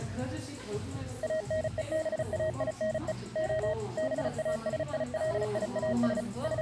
Morse code (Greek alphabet), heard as a keyed tone, machine-sent, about 35 wpm, 630 Hz, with the noise of a cafe. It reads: ΑΝΕΒΑΙΝΕ Ο ΒΑΣΙΛΙΑΣ …